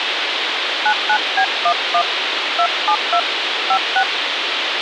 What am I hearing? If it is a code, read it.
DTMF, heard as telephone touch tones, dialled by hand, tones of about 80 ms, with radio hiss. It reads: 99B11 272 56